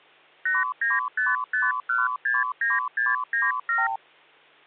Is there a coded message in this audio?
Yes: multi-frequency trunk signalling (R2, with the far end's replies) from 0.5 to 4.0 s, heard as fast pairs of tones, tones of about 180 ms. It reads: 8955169697